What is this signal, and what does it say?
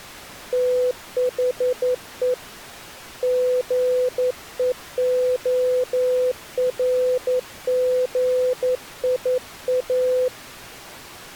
Morse code, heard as a keyed tone, hand-sent with a paddle, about 11 wpm, 500 Hz. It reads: THE GEORGIA